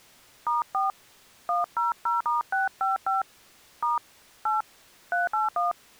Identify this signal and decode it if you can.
DTMF, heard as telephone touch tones, dialled by hand, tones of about 150 ms. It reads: *4 100*655 * 8 381